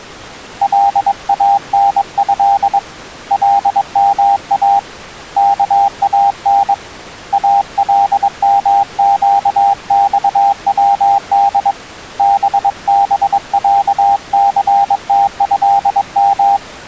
Morse code (Arabic alphabet), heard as a keyed tone, hand-sent with a paddle, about 22 wpm, 800 Hz. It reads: لانه لما كان المقصود ببعثتهم